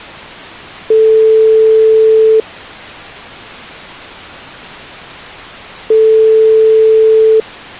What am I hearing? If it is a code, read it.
Telephone call progress tone (single-tone plan, as in most of Europe), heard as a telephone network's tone, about 440 Hz, 1.5 s on and 3.5 s off. Ringback tone.